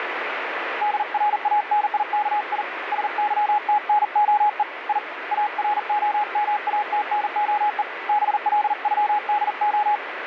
Morse code (Russian alphabet), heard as a keyed tone, hand-sent with a paddle, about 40 wpm, 840 Hz, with radio static. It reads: ДРАНИКИ СЫТНОЕ И АРОМАТНОЕ БЛЮДО